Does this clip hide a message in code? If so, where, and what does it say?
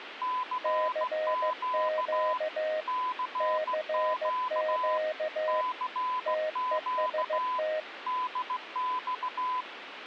Yes: Morse code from 0.2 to 9.7 s, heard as two keyed tones, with radio static. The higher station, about 16 wpm, 1010 Hz: CQ CQ CQ DX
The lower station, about 15 wpm, 620 Hz: CQ CQ TEST